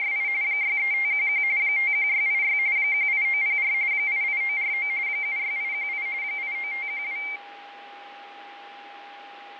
RTTY (45.45 baud, 170 Hz shift), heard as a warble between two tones, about 2200 Hz centre, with radio static, fading and a steady whistle near 810 Hz. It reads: … 63511 51686 18904 88949 76818 89512